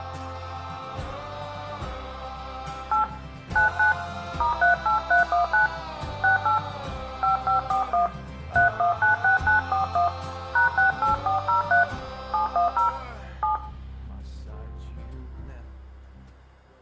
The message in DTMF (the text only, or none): 8 99 *38319 68 5541 3196941 #68403 710 7